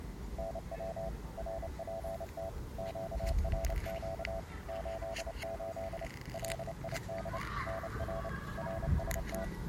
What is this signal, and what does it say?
Morse code, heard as a keyed tone, machine-sent, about 29 wpm, 660 Hz, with the noise of a residential street. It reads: NW RPT QRQ 88 LID NR RST